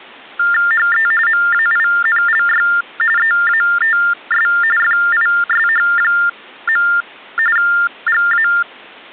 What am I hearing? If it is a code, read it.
TTY/TDD text telephone tones (45.45 baud Baudot), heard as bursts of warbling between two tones, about 400 Hz shift, 1600 Hz centre. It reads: HE MAINLY EATS FISH. GA